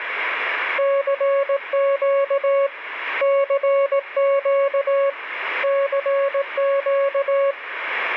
Morse code, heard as a keyed tone, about 18 wpm, 550 Hz, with radio static. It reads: CQ CQ CQ